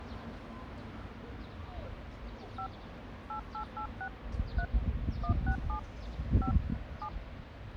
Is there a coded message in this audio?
Yes: DTMF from 2.6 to 7.1 s, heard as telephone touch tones, dialled by hand, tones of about 80 ms, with street noise. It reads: 5 8886 3 167 5 7